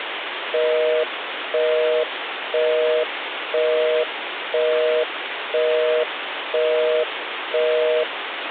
Telephone call progress tone (North American plan), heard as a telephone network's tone, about 480, 620 Hz, 0.5 s on and 0.5 s off, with phone line noise. Busy tone.